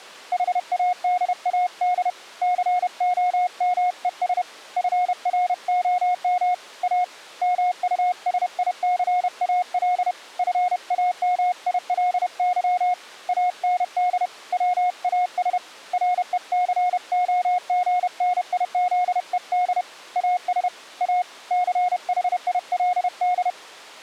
Morse code, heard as a keyed tone, hand-sent with a paddle, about 31 wpm, 720 Hz. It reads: HADAD COMES FROM A MUSICAL FAMILY AND WAS RECOGNIZED AS A CHILD